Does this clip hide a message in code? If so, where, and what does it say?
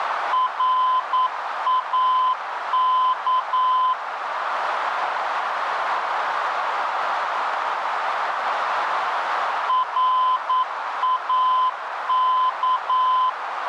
Yes: Morse code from 0.3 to 13.4 s, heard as a keyed tone, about 9 wpm, 1020 Hz, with radio static and a narrow filter. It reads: RAK RAK